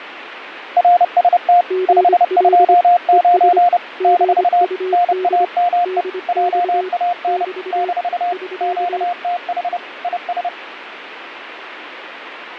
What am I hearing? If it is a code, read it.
Morse code, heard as two keyed tones, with radio static and fading. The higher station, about 30 wpm, 710 Hz: RST 529 - NAME JAN - QTH IS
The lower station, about 25 wpm, 370 Hz: GL ES GUD DX <BT> <SK>